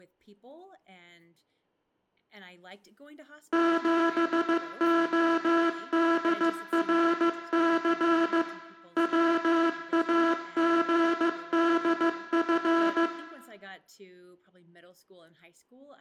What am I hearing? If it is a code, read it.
Morse code, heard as a buzzer, machine-sent, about 15 wpm, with room echo and speech in English. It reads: 7ODRC WAGDF